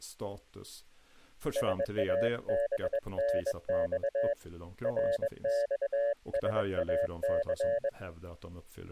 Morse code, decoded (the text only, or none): SABNX RXSAC